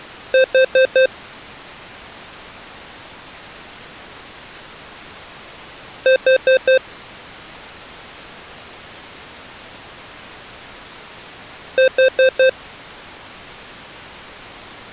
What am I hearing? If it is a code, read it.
Alarm pattern, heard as an alarm's beeps, played three times, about 520 Hz. Temporal four. Carbon monoxide.